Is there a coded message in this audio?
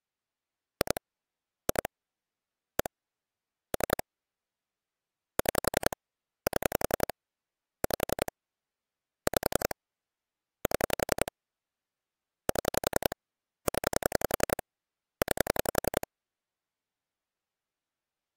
Yes: pulse dialling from 0.8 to 16.0 s, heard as clicks on a phone line, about 11 pulses a second. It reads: 2 2 1 3 6 7 5 5 7 7 0 9